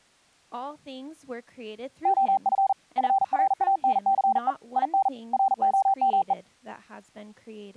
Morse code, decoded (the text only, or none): OF FRANCE IN ROME